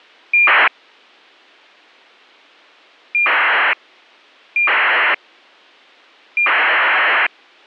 ACARS aircraft data, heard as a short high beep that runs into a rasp, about 2400 baud.